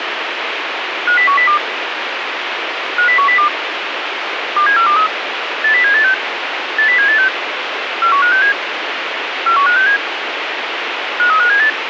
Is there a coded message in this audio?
Yes: five-tone selective call (CCIR) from 1.1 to 11.7 s, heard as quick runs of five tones, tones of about 100 ms, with radio hiss. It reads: 50102 50102 27423 80786 80786 41567 41567 53578